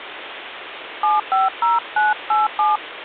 DTMF, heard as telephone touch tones, dialled by hand, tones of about 170 ms, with phone line noise. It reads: 750987